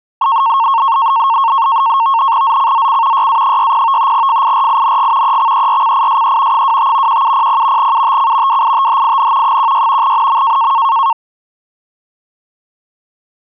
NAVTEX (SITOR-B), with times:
2.4-3.3 ZCZC
3.1-4.1 YA60
4.1-5.4 FIRING
5.2-6.6 EXERCISE
6.5-7.2 25
7.1-7.9 1700
7.8-8.6 UTC
8.5-9.6 WITHIN
9.4-10.1 16
10.0-10.7 NM

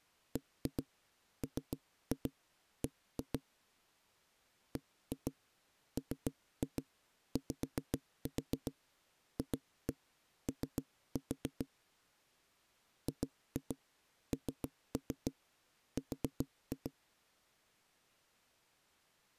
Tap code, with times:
0.4-3.4 BMB
4.8-11.7 BMYFO
13.1-16.9 GNR

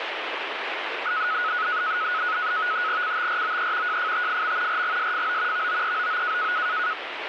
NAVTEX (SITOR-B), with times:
3.0-4.0 CTROE
3.9-4.8 JFTFM
4.7-5.7 RGSFO
5.5-6.5 VOEOO

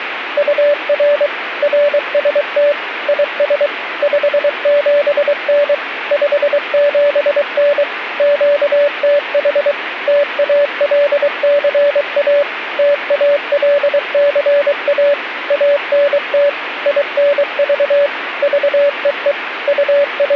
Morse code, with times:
0.4-1.3 UR
1.6-2.7 RST
3.1-3.7 IS
4.0-5.7 57N
6.1-7.8 57N
8.2-9.7 QTH
10.1-12.4 TALCA
12.8-15.1 TALCA
15.5-16.5 ANT
16.9-18.1 INV
18.4-19.3 VEE
19.7-20.4 …

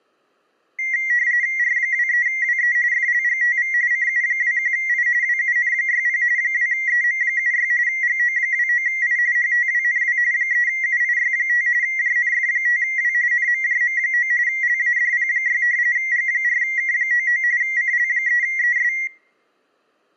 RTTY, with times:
1.6-2.8 R23WE
2.9-3.7 FLGTV
3.9-5.1 CU21I
5.2-6.2 WUN60
6.4-7.7 2EM76
7.9-9.2 GO29I
9.4-10.2 HTWNW
10.3-11.7 3UIY5
11.8-13.1 JNF5W
13.3-14.3 NMJM9
14.5-15.6 LADP6
16.0-17.4 G4K99
17.6-18.9 CL3ES

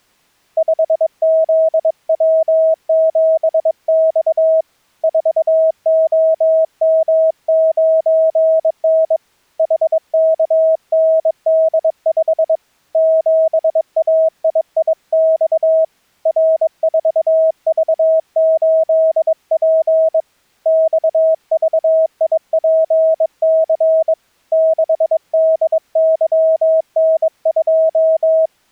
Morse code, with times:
0.6-4.6 5ZW7X
5.0-9.2 4OM9N
9.6-12.6 HKND5
13.0-15.8 7AIIX
16.3-20.2 R4V8P
20.7-24.1 XVIPC
24.5-28.5 6DYN2

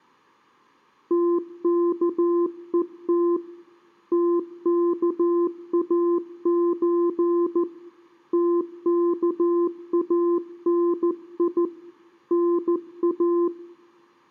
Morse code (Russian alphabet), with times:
1.1-3.4 ТКЕТ
4.1-7.6 ТКАЧ
8.3-11.6 ТКАНИ
12.3-13.5 НА

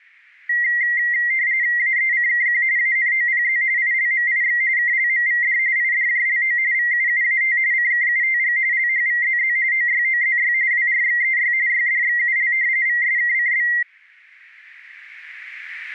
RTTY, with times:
1.8-2.6 AECKQ
2.8-3.6 ANOPZ
3.8-4.6 ILMIX
4.8-5.6 KLMVD
5.8-6.6 IDJLO
6.7-7.6 VUUAT
7.7-8.6 CKUTG
8.7-9.6 LHVZZ
9.7-10.5 OYOZY
10.7-11.5 WRXEY
11.7-12.5 YDXUL
12.9-13.7 VSKCB

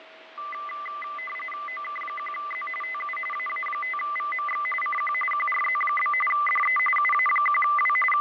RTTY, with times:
1.7-2.7 OK1Z
2.8-3.2 TU
3.3-4.7 AA5VMX
4.8-5.1 CQ
5.3-6.1 QRZ?
6.3-6.8 DE
7.0-8.0 UA1W
8.1-8.2 …

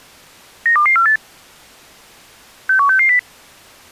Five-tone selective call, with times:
0.7-1.2 92248
2.7-3.2 61660

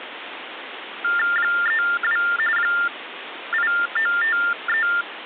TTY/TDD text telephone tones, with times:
1.4-2.2 32
2.6-4.9 8953

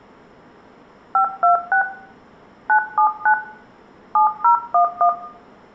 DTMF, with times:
1.1-1.8 526
2.7-3.3 979
4.2-5.1 7011

